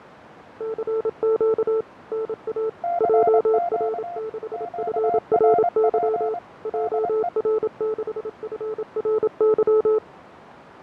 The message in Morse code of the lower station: CQ NA JR6FRY JR6FRY

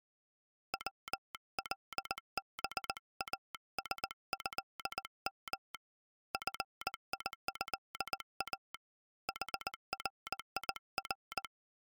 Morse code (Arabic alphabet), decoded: ولباسهم فيها حرير

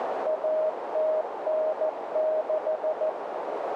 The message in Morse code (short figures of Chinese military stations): 1096

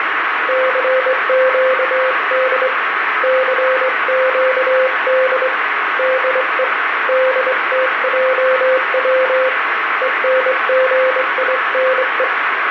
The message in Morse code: CQD CQD DE DTJW ENGINE

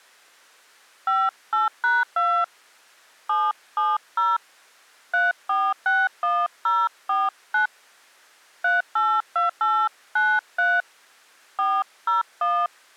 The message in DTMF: 58#2 770 3461049 382893 401

